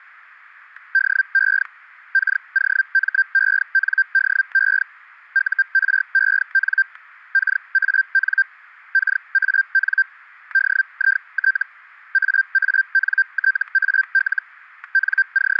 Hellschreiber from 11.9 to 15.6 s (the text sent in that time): AANTAL …